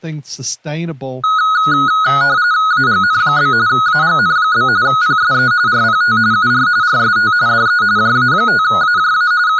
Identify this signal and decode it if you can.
RTTY (45.45 baud, 170 Hz shift), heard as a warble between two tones, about 1360 Hz centre, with speech in English. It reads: AGN? AGN? PSE RPT UR RST DE JA5AJA …